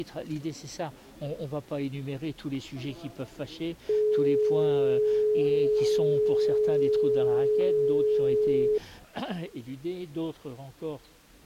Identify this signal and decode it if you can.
Telephone call progress tone (425 Hz plan, as in most of Europe), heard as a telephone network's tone, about 420 Hz. Dial tone.